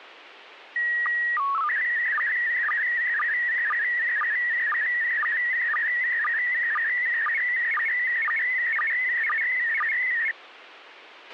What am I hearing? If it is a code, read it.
SSTV (slow-scan television), PD 120, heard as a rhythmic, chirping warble, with radio hiss and a squelch burst at the end.